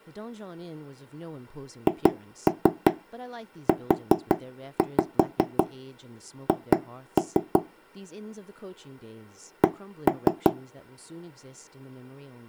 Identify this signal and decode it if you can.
Tap code, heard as knocks on wood, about 5 knocks a second, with speech in English. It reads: HUH C